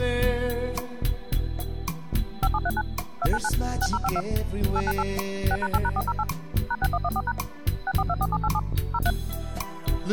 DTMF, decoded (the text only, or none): 5739 299 6052 898 6#8#408 #6114# 6424787 03